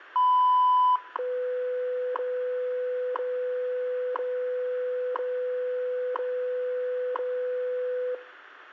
Radio time signal (WWV, Colorado), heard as ticks, one a second.